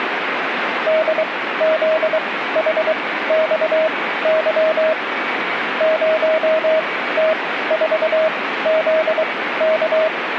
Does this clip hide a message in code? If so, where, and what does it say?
Yes: Morse code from 0.8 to 10.1 s, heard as a keyed tone, machine-sent, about 23 wpm, spaced as for 15 wpm, 630 Hz, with radio static. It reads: DZHXY 0T4ZK